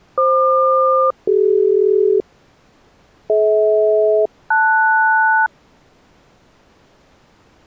Aircraft SELCAL, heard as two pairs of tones. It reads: FQ-CD DH-LS